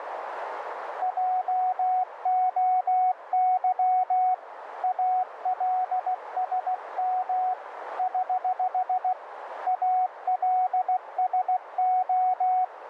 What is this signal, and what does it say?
Morse code, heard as a keyed tone, hand-sent with a paddle, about 16 wpm, 740 Hz, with radio static and a narrow filter. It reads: JOY ALSM <HH> ALSO